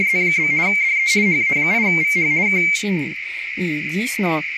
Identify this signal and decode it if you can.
RTTY (50 baud, 170 Hz shift), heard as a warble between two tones, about 2200 Hz centre, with radio static, a narrow filter and speech in Ukrainian. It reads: … DE HA8VH K